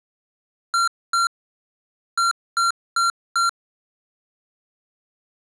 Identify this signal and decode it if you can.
Beep code, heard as beeps from a small speaker, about 1370 Hz. 2-4.